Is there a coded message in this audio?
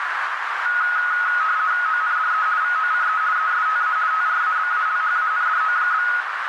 Yes: RTTY (50 baud, 170 Hz shift) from 0.7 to 6.2 s, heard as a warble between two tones, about 1360 Hz centre, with radio static and a narrow filter. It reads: ONDE VOCE ESTA TRABALHANDO?